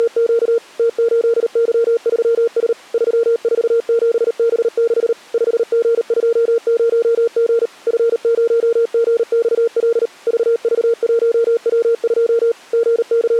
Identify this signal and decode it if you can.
Morse code, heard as a keyed tone, machine-sent, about 38 wpm, 460 Hz. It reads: … T8Y3S 347B6 5G20G F0GXL VV1W2 …